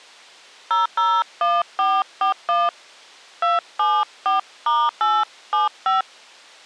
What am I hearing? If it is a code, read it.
DTMF, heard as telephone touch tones, dialled by hand, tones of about 170 ms. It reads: 001441 274*875